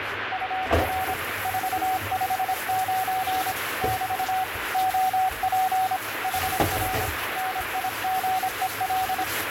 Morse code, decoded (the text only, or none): UR 459 <BT> OP HR NIGEL